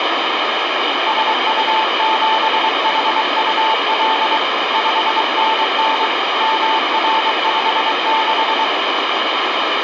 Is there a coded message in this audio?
Yes: Morse code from 1.0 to 8.7 s, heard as a keyed tone, hand-sent with a paddle, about 23 wpm, 880 Hz, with heavy radio static. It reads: SU7HUL 5NN MR56